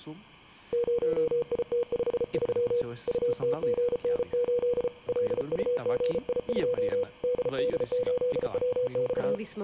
Morse code, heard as a keyed tone, hand-sent with a paddle, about 34 wpm, 490 Hz, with speech in Portuguese. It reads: 0IT53 UTGN8 LUGI2 DD8WX